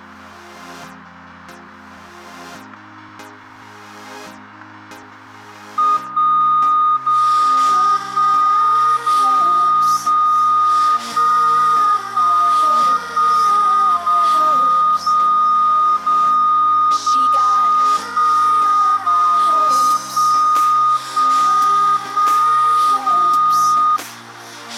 Radio time signal (DCF77), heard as a tone whose level steps once a second, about 1230 Hz. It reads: 1 0 1 0 0 1 1 1 0 0 0 0 1 0 1 1 1 0